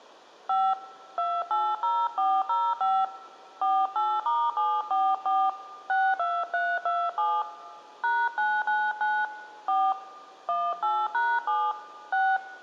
DTMF, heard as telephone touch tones, dialled by hand, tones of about 240 ms, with room echo. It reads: 5 280405 48*744 62327 #999 4 18#7 6